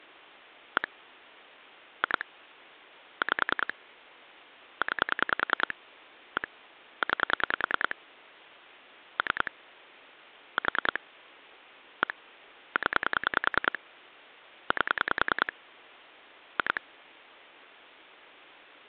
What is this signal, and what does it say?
Pulse dialling, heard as clicks on a phone line, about 10 pulses a second. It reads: 1 2 5 9 1 9 3 4 1 0 8 2